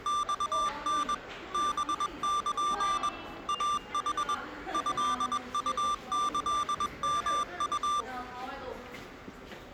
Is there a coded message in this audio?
Yes: Morse code (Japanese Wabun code) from 0.0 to 8.1 s, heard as electronic beeps, machine-sent, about 21 wpm, 1180 Hz, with the noise of a subway station. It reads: マタ ハル イヌ トウキヨウ